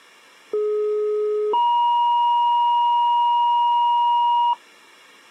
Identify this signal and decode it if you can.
Two-tone page, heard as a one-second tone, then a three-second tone, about 420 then 950 Hz.